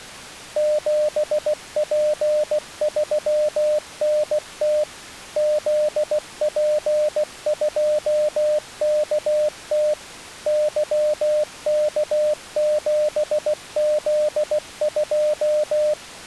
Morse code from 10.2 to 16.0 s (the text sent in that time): YK7Z2